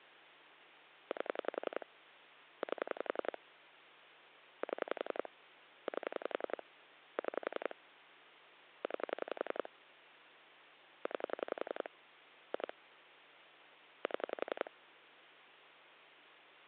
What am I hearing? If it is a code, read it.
Pulse dialling, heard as clicks on a phone line, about 11 pulses a second, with hum. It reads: 8 8 7 8 6 9 9 2 7